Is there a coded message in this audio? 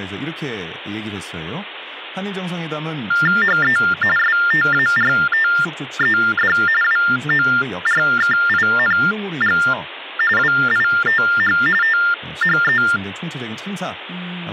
Yes: TTY/TDD text telephone tones (45.45 baud Baudot) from 3.1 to 13.0 s, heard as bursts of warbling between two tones, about 400 Hz shift, 1600 Hz centre, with speech in Korean. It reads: HE STARTED WORKING WITH THE